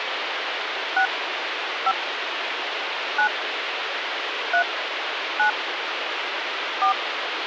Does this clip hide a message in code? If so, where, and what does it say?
Yes: DTMF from 1.0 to 6.9 s, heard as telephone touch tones, dialled by hand, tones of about 90 ms, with phone line noise. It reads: 6 5 9 3 9 4